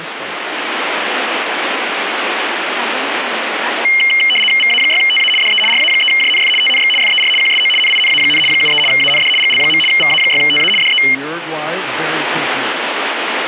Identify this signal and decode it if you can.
RTTY (75 baud, 850 Hz shift), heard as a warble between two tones, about 2550 Hz centre, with radio static. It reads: VA6TA DE RA3JNF TNX FER QSO NINA, 73 AND GL. VA6TA DE